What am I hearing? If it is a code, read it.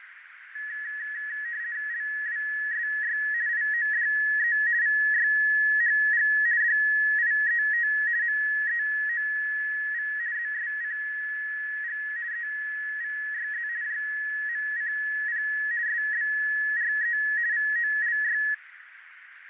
RTTY (50 baud, 170 Hz shift), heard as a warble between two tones, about 1800 Hz centre, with radio static, fading and a narrow filter. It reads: LWSY IODE VYHG DIET MEOV ZSCG EVYZ JMCP SBRE VOLY